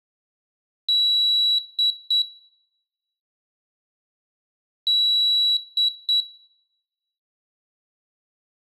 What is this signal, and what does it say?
Beep code, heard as a piezo beeper, played twice, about 3900 Hz, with room echo. 1 long, 2 short. In Award, IBM and AMI BIOS tables: video adapter failure.